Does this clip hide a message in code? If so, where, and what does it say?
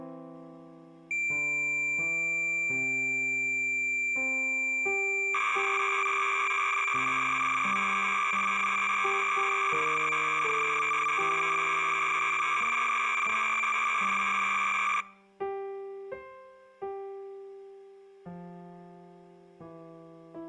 Yes: cassette data (Kansas City type), 300 baud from 1.1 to 15.0 s, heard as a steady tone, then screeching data.